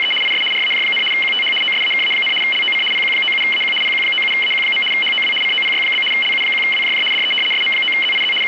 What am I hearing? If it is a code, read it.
RTTY (75 baud, 850 Hz shift), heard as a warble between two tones, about 2550 Hz centre, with radio static. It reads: … IS RAJ, QTH OSAKA, LOC PQ97AQ PQ97AQ. HOW COPY? LU1WJJ DE SM9ZIZ …